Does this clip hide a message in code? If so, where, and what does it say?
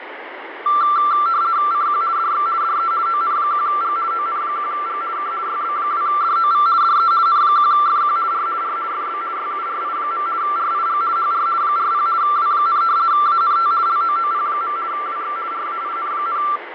Yes: RTTY (50 baud, 170 Hz shift) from 0.7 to 16.6 s, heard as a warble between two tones, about 1260 Hz centre, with radio static and fading. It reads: CQ DX DE ON1G ON1G K YB2DOV DE N1FQ R R FB YURI. RIG HR 40 W, ANT LOOP. WX RAIN,